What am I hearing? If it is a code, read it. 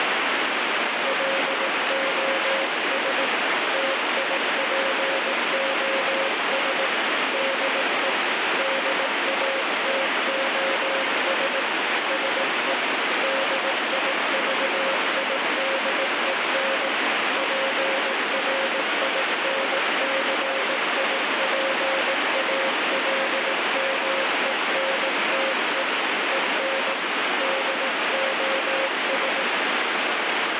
Morse code, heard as a keyed tone, hand-sent with a paddle, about 18 wpm, 540 Hz, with heavy radio static. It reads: LOS TIPOS DE DATOS SE DIVIDEN PRINCIPALMENTE EN DOS